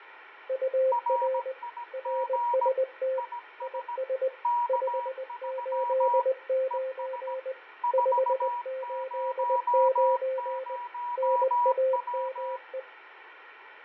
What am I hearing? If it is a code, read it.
Morse code, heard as two keyed tones, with radio static and fading. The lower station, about 20 wpm, 520 Hz: UR RST IS 589 589 NAME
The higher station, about 17 wpm, 960 Hz: RIG IS K3 ES 400W